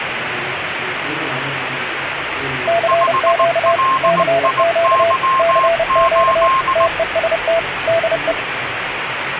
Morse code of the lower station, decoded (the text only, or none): CQ CQ CQ TEST DE